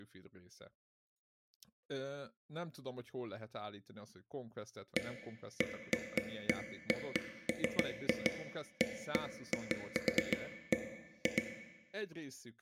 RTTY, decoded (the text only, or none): none